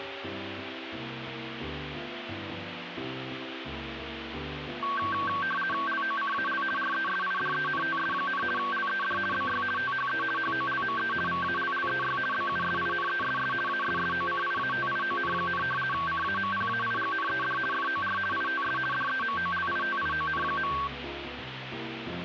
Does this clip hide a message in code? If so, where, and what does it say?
Yes: RTTY (50 baud, 450 Hz shift) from 4.8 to 20.9 s, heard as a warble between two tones, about 1340 Hz centre, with radio static. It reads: LOCAL RESIDENTS, LED BY THE HOLME VALLEY BUSINESS ASSOCIATION, CAMPAIGNED FOR ITS DEMOLITION.